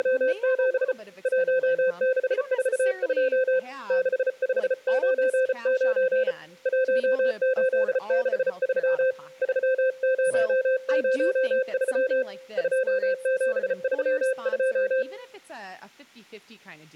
Morse code, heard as a keyed tone, hand-sent with a paddle, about 34 wpm, 520 Hz, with speech in English. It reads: … 1642 6599 1863 3003 2732